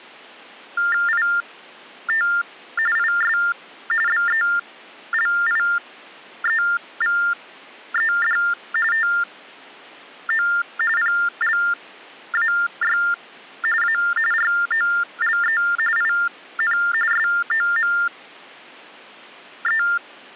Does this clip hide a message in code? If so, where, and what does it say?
Yes: TTY/TDD text telephone tones (45.45 baud Baudot) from 0.8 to 20.0 s, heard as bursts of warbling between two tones, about 400 Hz shift, 1600 Hz centre. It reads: IT IS BELIEVED TO PLAY A ROLE IN SOME